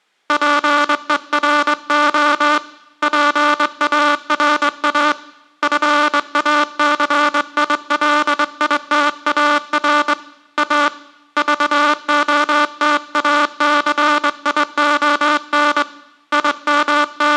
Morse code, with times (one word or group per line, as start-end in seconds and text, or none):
0.3-2.6 PERO
3.0-5.1 PARA
5.6-10.1 FACILITAR
10.6-10.9 A
11.4-15.8 VOTACION
16.3-17.4 …